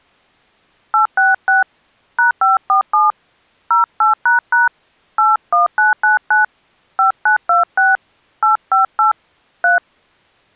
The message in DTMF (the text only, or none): 866 #547 08## 81999 5926 858 3